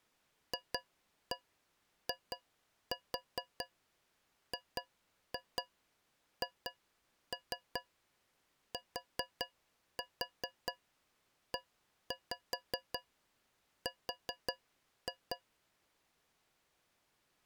Tap code, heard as taps on a metal pipe, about 4 knocks a second. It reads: FIGHTER